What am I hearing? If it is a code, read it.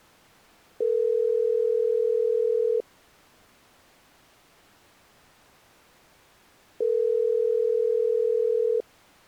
Telephone call progress tone (North American plan), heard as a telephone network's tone, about 440, 480 Hz, 2 s on and 4 s off. Ringback tone.